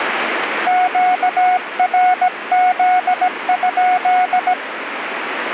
Morse code, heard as a keyed tone, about 17 wpm, 730 Hz, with radio static. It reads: QRZ?